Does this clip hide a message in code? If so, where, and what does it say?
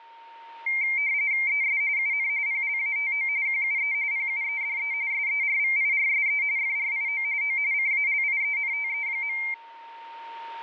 Yes: RTTY (45.45 baud, 170 Hz shift) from 0.7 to 9.5 s, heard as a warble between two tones, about 2200 Hz centre, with a steady whistle near 920 Hz. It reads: ES UN PLATO QUE PUEDE SERVIRSE FRIO O CALIENTE.